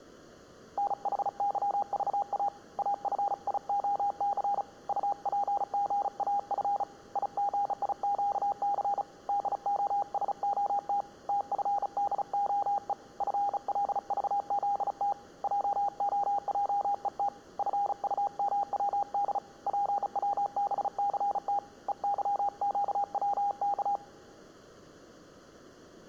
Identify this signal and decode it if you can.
Morse code, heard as a keyed tone, hand-sent with a bug key, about 35 wpm, 810 Hz. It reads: NHYVA AFIOC UPGAF IGIQC DOSOT TFDOE FLVZT JOJET FUMWD PWBCT EYQWK